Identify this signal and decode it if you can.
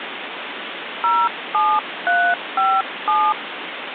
DTMF, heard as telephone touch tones, dialled by hand, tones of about 260 ms, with phone line noise. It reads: 07357